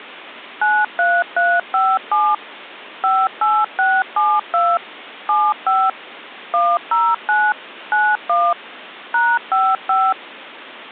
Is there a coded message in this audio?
Yes: DTMF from 0.6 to 10.1 s, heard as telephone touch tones, dialled by machine, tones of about 230 ms. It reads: 93357 58672 75 109 91 #55